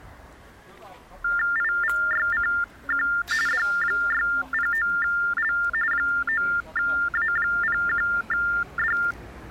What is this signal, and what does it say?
TTY/TDD text telephone tones (45.45 baud Baudot), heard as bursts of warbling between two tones, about 400 Hz shift, 1600 Hz centre, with the noise of a residential street. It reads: IVYCQ D609L 9A01D